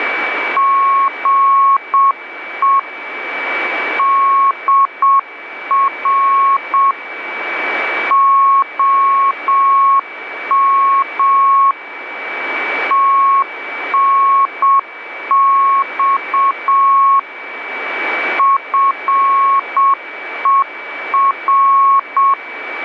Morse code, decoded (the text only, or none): GE DR OM TNX FER